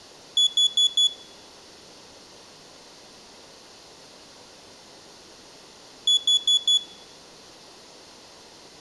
Alarm pattern, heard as an alarm's beeps, played twice, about 3400 Hz. Temporal four. Carbon monoxide.